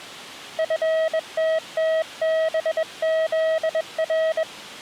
Morse code, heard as a keyed tone, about 21 wpm, 640 Hz. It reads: FTTBZR